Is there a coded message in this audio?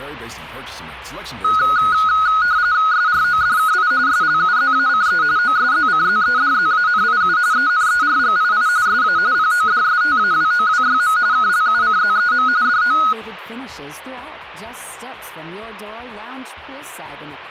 Yes: RTTY (45.45 baud, 170 Hz shift) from 1.4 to 13.1 s, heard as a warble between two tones, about 1360 Hz centre. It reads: SRODKI SLUZACE OSZCZEDZANIU ENERGII SA PODSTAWOWYM KLUCZEM DO